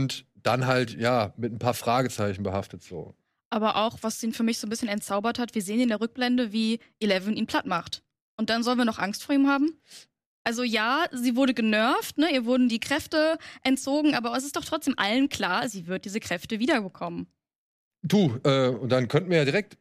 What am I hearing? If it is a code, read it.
Speech in German. There is no code.